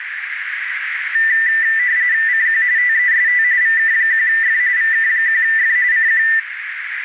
RTTY (45.45 baud, 170 Hz shift), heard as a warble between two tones, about 1900 Hz centre, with radio static and a narrow filter. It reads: CQ TEST VK1F VK1F CQ